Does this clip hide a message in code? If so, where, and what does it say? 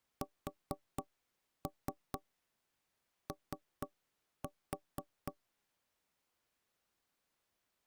Yes: tap code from 0.2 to 5.4 s, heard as knocks on wood, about 4 knocks a second. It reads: SO